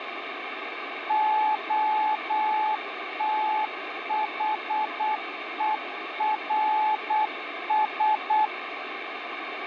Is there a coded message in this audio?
Yes: Morse code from 1.0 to 8.5 s, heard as a keyed tone, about 8 wpm, 860 Hz, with radio static. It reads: OTHERS